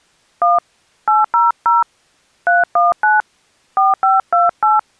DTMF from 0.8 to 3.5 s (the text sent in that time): 800 319